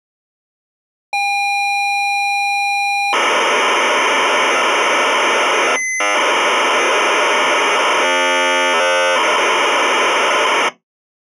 ZX Spectrum tape loading, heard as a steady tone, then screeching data.